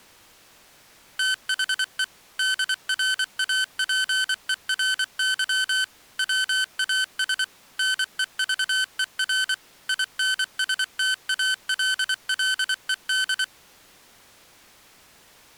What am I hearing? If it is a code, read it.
Morse code, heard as electronic beeps, machine-sent, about 24 wpm, 1550 Hz. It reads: THE DRAPERY WAS NEVER INSTALLED